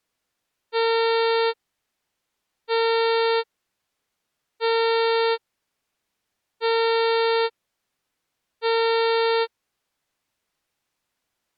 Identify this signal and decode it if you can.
Ship horn signal, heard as a ship's horn, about 460 Hz. 5 short. At sea: I doubt that you are doing enough to avoid a collision.